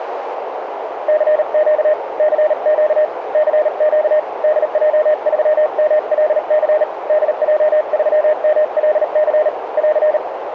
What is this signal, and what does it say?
Morse code, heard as a keyed tone, hand-sent with a paddle, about 38 wpm, 610 Hz, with radio static and a narrow filter. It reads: CQ CQ CQ DJ3MLC DJ3MLC <AR>